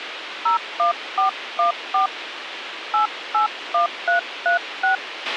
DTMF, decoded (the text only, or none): 01414 881336